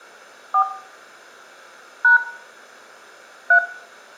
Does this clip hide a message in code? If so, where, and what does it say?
Yes: DTMF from 0.5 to 3.6 s, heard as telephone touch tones, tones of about 90 ms, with room echo. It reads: 4 # 3